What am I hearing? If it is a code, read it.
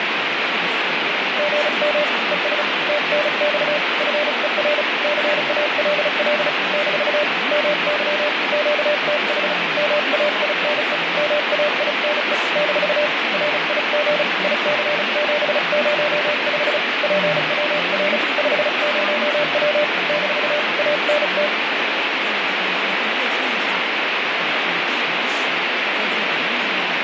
Morse code, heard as a keyed tone, hand-sent with a paddle, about 35 wpm, 590 Hz, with heavy radio static and speech in Chinese. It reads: GM ES TNX FER CALL - MY QTH MAINE MAINE - RIG IC705 PWR 50W - ANT